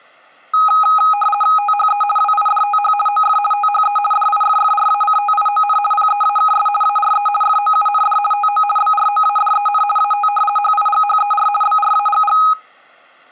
RTTY (50 baud, 450 Hz shift), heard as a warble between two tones, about 1040 Hz centre. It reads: THE WIDTH OF THE DIFFRACTION PEAKS ARE FOUND TO BROADEN AT HIGHER BRAGG